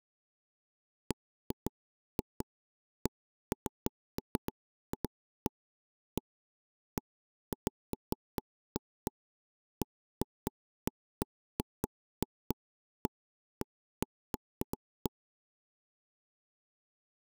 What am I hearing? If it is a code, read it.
Irregular taps on a table. There is no code.